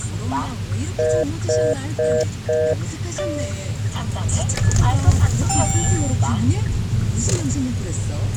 Telephone call progress tone (North American plan), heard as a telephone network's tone, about 480, 620 Hz, 0.25 s on and 0.25 s off, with the noise inside a car. Congestion tone.